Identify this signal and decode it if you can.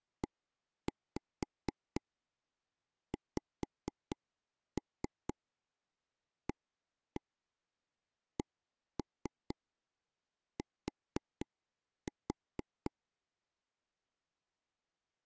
Tap code, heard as taps on a table, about 4 knocks a second. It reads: EXACT